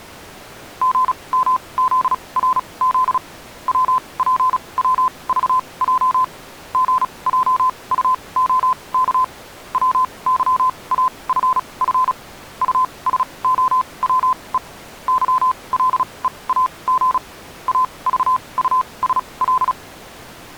Morse code, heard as a keyed tone, machine-sent, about 36 wpm, spaced as for 25 wpm, 1020 Hz. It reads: GMZRZ WPWVJ GJUOK WYAFF USOWE YLEAG AVUSL